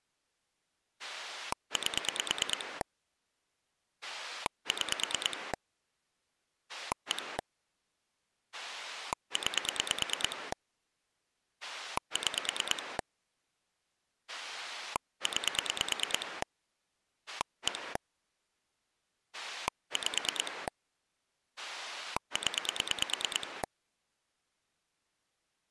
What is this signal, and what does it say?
Pulse dialling, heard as a rotary dial, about 9 pulses a second. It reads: 8 6 1 9 6 9 1 5 0